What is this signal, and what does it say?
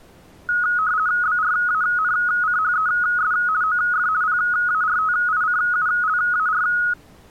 RTTY (50 baud, 170 Hz shift), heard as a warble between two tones, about 1360 Hz centre. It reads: BRANCHES OF PARTICULAR